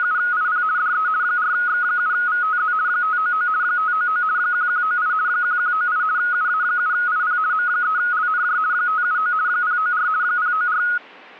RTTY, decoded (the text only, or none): … DE 4X7VTZ 599 599 1198 1198 UA7IP M3LNJ 579 094 094